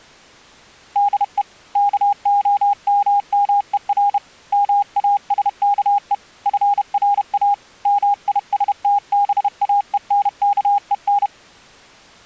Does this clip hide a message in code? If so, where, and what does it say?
Yes: Morse code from 0.9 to 11.3 s, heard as a keyed tone, hand-sent with a bug key, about 31 wpm, 810 Hz. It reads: DE KOMMER MASKE FRA MISTBAENKEN